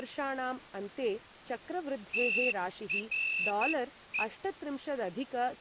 Morse code, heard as a whistle, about 11 wpm, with speech in Sanskrit. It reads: TRE